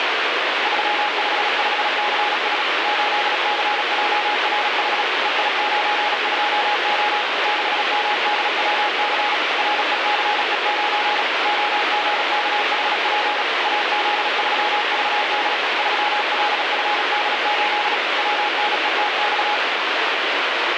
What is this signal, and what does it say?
Morse code, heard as a keyed tone, machine-sent, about 36 wpm, 830 Hz, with heavy radio static. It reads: 355CS 8CJRH EI92O 6MDWC RECE9 OGKHP AZ3VD 3LFD8 WNETX